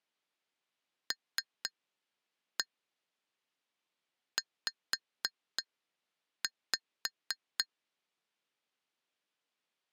Tap code, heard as taps on glass, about 3 knocks a second. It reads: LZ